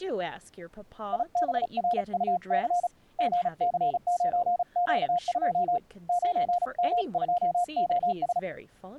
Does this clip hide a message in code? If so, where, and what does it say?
Yes: Morse code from 1.1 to 8.5 s, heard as a keyed tone, hand-sent with a paddle, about 35 wpm, 710 Hz, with speech in English. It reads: IBRUC GC9Q2 9M2OS